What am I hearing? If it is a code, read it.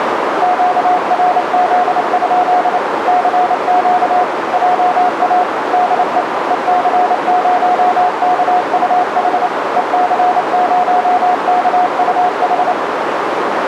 Morse code, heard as a keyed tone, machine-sent, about 28 wpm, 720 Hz, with radio static and a narrow filter. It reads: QRZ? CQ JA DE EC0KUH EC0KUH